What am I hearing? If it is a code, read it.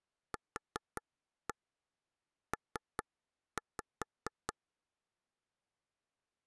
Tap code, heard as taps on a table, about 5 knocks a second. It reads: QP